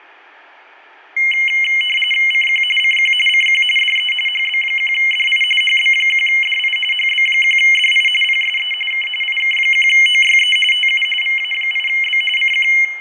RTTY (45.45 baud, 850 Hz shift), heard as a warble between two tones, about 2550 Hz centre, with fading and room echo. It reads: CQ CQ CQ DE HB1DI HB1DI HB1DI PSE K IK1OYE TU VA8B CQ